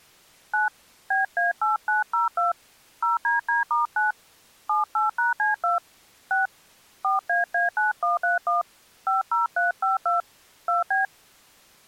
DTMF, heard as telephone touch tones, dialled by hand, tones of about 150 ms. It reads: 9 BA8902 0DD*9 78#C2 6 4AA9131 50352 2B